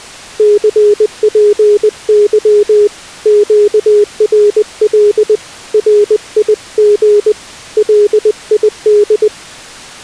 Morse code, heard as a keyed tone, hand-sent with a paddle, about 20 wpm, 410 Hz. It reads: CPY QRL RIG LID